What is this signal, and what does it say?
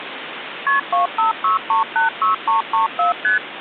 Multi-frequency trunk signalling (R1, as on North American trunks), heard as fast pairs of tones, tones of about 130 ms, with phone line noise. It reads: KP 256386334 ST